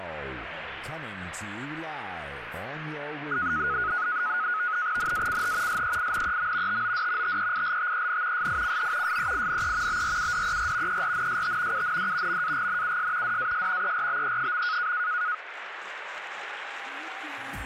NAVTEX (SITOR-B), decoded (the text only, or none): NACH SEINEM TOD TEILTEN SICH SEINE BRUDER ERNST UND MAGNUS DAS ERBE.